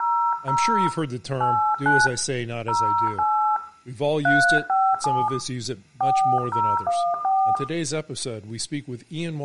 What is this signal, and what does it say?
DTMF, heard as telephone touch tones, dialled by hand, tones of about 290 ms, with room echo and speech in English. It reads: 00 89 08 357 4014